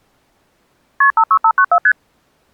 Multi-frequency trunk signalling (R1, as on North American trunks), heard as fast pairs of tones, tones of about 70 ms. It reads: KP 56594 ST